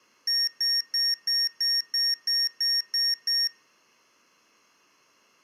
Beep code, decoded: 10 short

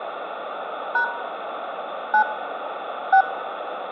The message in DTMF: # 9 6

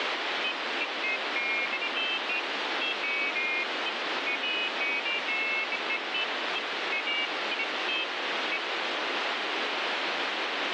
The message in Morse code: none

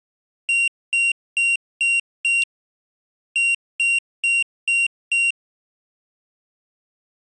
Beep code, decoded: 5-5

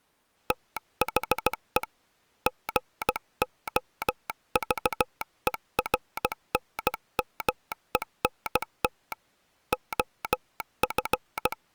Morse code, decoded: THE GOVERNMENT OF

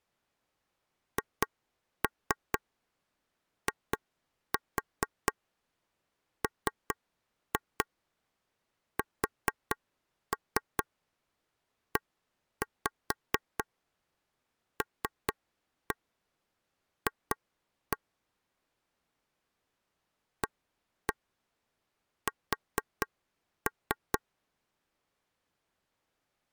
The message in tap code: HIMSELF AS

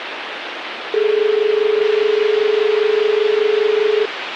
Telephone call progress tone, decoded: dial tone

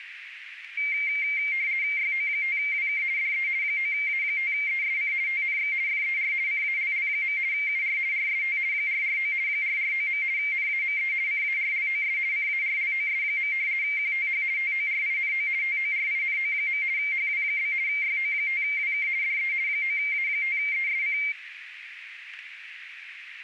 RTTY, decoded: YO5WK DE 9A5ESC TNX FER CALL. UR RST 449 449. NAME CARLOS CARLOS. QTH TORINO TORINO. HW? YO5WK DE 9A5ESC

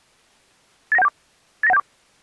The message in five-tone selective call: 89174 89174

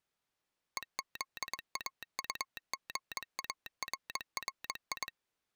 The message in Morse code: EZAUGARRI

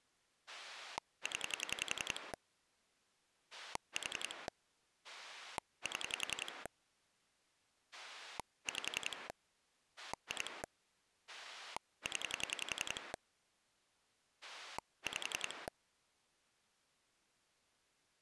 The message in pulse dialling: 0 4 7 5 2 0 5

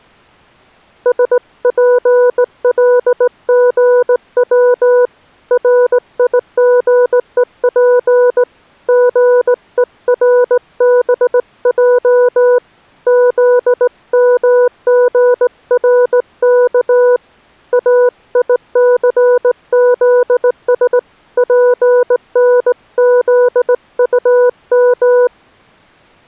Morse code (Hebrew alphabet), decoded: שפלגץ ריגוף גורבע זמגרך איסזש פנזטם

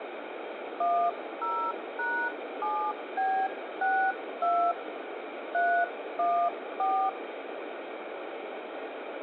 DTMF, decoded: 10#7B62 314

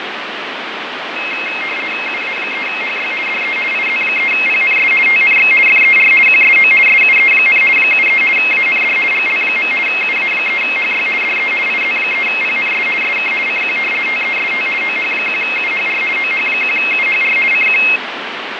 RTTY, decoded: UA3HY DE IZ3PNS TNX FER QSO SUE, 73 AND GL. UA3HY DE IZ3PNS SK CQ TEST OH1UHR OH1UHR CQ

